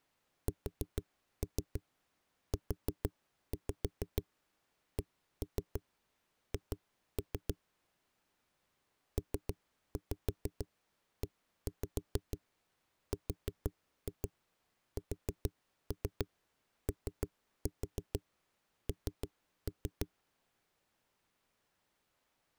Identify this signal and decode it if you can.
Tap code, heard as knocks on a wall, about 6 knocks a second. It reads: SUCH PERSON